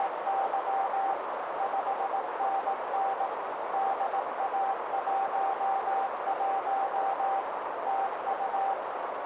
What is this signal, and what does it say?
Morse code, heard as a keyed tone, machine-sent, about 18 wpm, 780 Hz, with heavy radio static and a narrow filter. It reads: … 5NN DA11 TU